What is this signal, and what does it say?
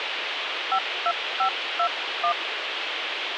DTMF, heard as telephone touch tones, dialled by hand, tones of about 80 ms, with radio hiss. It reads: 52521